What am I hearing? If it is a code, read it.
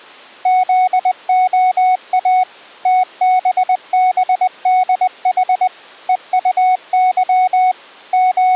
Morse code, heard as a keyed tone, machine-sent, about 20 wpm, 740 Hz. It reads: ZOA TBBDH EUY …